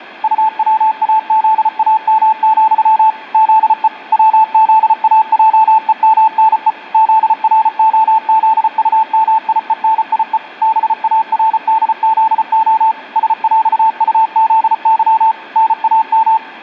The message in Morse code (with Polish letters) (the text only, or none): UWAZAM, ZE WZAJEMNE ZROZUMIENIE BARDZO SŁUZY NAM